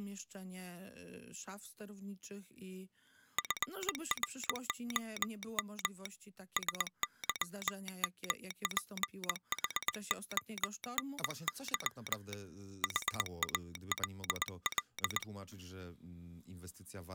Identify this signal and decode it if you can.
Morse code, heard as a telegraph sounder, hand-sent with a paddle, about 20 wpm. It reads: FROM SYMPHONY HALL